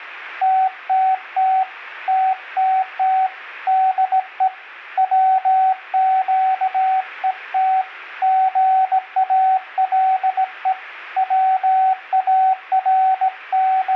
Morse code, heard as a keyed tone, hand-sent with a straight key, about 17 wpm, 760 Hz. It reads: TTT TTT DE WQET GALE …